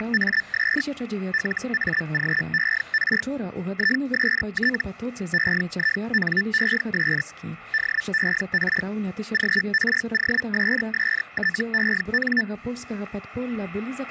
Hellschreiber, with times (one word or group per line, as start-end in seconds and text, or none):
0.0-0.8 …
1.3-3.2 LAGER
3.7-4.8 IST
5.3-7.2 EINES
7.7-8.8 DER
9.3-12.4 GROSSTEN